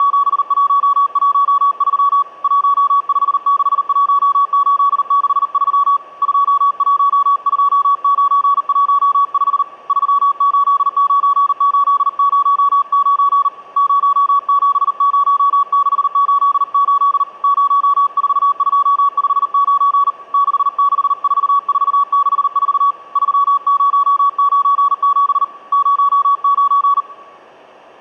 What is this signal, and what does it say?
Morse code, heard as a keyed tone, hand-sent with a paddle, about 39 wpm, 1130 Hz. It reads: … 1561863 212915 389809 070688 04259 664464 3097 09